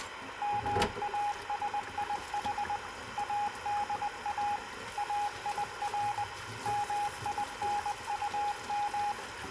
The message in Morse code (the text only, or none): MASIH ADA AIR MINUM